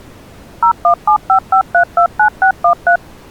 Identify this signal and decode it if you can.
DTMF, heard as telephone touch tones, dialled by machine, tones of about 90 ms. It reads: 01755329613